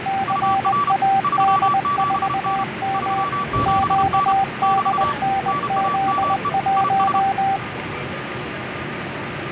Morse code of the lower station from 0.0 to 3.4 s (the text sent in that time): CAD4M